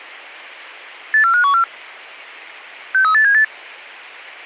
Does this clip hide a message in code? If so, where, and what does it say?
Yes: five-tone selective call (CCIR) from 1.1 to 3.4 s, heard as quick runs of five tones, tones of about 100 ms. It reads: 84514 63878